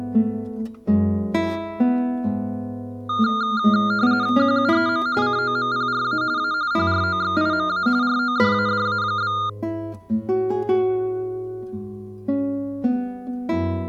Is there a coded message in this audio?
Yes: RTTY (45.45 baud, 170 Hz shift) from 3.1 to 9.5 s, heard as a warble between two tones, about 1310 Hz centre. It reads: QUEM COMPRA A PROXIMA RODADA?